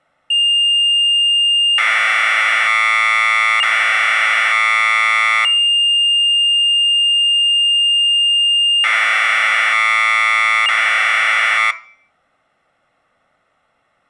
Commodore tape loading (standard loader), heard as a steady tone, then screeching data, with room echo.